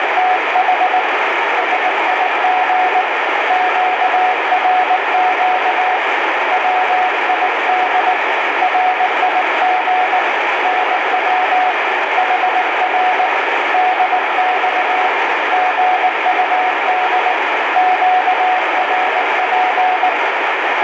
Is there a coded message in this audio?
Yes: Morse code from 0.0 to 20.2 s, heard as a keyed tone, hand-sent with a paddle, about 19 wpm, 740 Hz, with heavy radio static. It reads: … SIG QRQ WID RIG NW HR DX GUD QRP